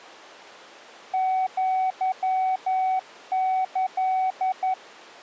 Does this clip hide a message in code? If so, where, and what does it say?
Yes: Morse code (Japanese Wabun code) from 1.1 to 4.8 s, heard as a keyed tone, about 11 wpm, 750 Hz. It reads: アキ